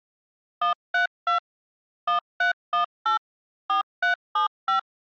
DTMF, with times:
0.6-1.4 132
2.1-3.2 1318
3.7-4.8 4375

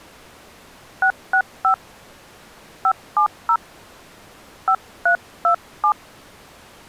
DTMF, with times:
1.0-1.7 665
2.9-3.6 570
4.7-5.9 5327

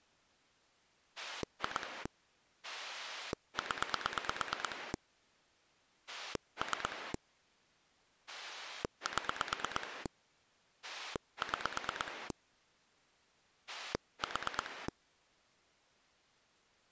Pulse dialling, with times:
1.2-2.1 2
2.6-4.9 0
6.1-7.1 3
8.3-10.1 7
10.8-12.3 6
13.7-14.9 4

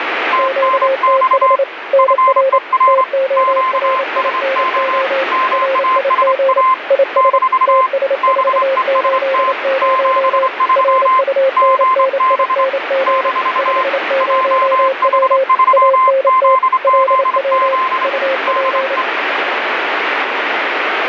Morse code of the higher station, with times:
0.3-1.6 TNX
2.0-3.0 FER
3.4-5.0 QSO
5.3-6.7 MASA
7.2-7.9 -
8.2-9.5 BEST
9.8-11.2 73
11.6-12.6 GB
13.1-13.8 -
14.2-18.1 JH3ZZZ
18.5-19.0 DE

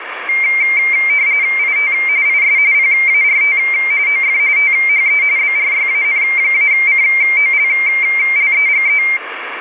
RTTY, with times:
1.6-1.9 IT
2.3-2.6 IS
2.7-3.6 PART
4.1-4.4 OF
4.6-5.2 THE
5.4-9.0 BRYAN-COLLEGE

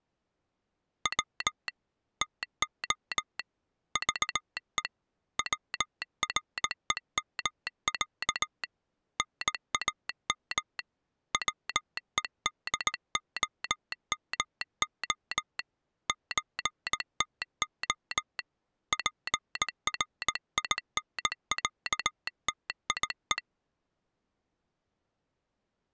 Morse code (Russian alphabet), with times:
1.1-1.7 В
2.2-3.4 ТО
4.0-4.8 ЖЕ
5.4-8.6 ВРЕМЯ
9.2-10.8 НАМ
11.3-15.6 ВЕДОМО
16.1-18.4 ЧТО
18.9-23.4 ПРИНЯТИЕ

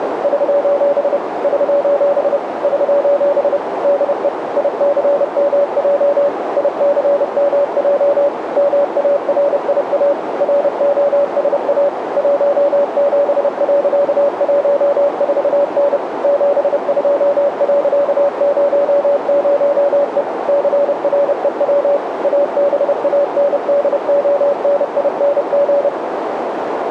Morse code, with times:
0.2-1.2 <SOS>
1.4-2.4 <SOS>
2.6-3.6 <SOS>
3.8-4.3 DE
4.6-6.3 ICMJ
6.6-8.3 ICMJ
8.6-10.1 MARIA
10.4-11.9 ROSA
12.2-16.0 17.14N
16.2-20.2 72.00E
20.5-22.0 CREW
22.2-25.9 ABANDONING

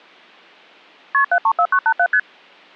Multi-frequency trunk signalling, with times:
1.1-1.2 KP
1.3-2.1 734987
2.1-2.2 ST

